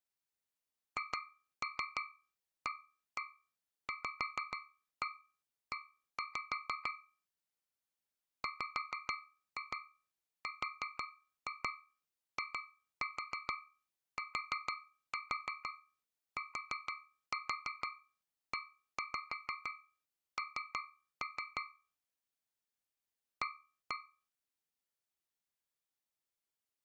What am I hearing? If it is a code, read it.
Tap code, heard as taps on a metal pipe, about 6 knocks a second. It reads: HAVE WRITTEN A